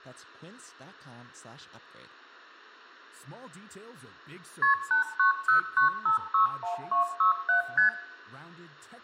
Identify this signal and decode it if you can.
Multi-frequency trunk signalling (R1, as on North American trunks), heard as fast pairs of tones, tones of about 120 ms, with room echo and speech in English. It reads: KP 8909561267 ST